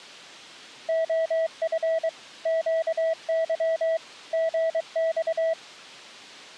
Morse code, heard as a keyed tone, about 23 wpm, 650 Hz. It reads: OF QY GX